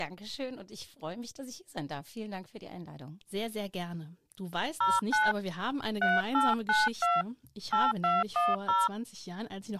DTMF, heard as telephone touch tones, dialled by hand, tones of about 190 ms. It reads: 09 3892 8210